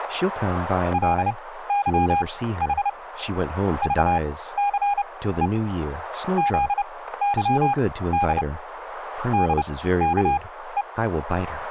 Morse code, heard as a keyed tone, machine-sent, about 30 wpm, spaced as for 16 wpm, 810 Hz, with radio static, static crashes and speech in English. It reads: LYH VCE ZYD DKE